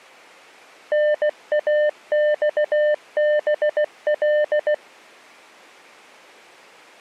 Morse code (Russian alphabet), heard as a keyed tone, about 16 wpm, 600 Hz. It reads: НАЬБЛ